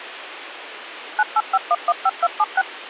DTMF, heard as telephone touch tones, dialled by machine, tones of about 40 ms, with phone line noise. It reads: 985115276